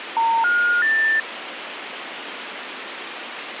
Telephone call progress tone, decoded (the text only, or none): special information tone